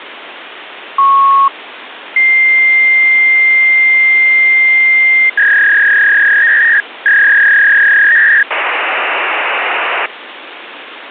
Fax machine handshake, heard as a beep, a long tone, a warble and hiss, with phone line noise.